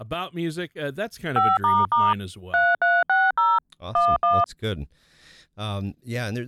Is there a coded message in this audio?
Yes: DTMF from 1.4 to 4.4 s, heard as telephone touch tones, dialled by machine, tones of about 210 ms, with speech in English. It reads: 5** 3360 11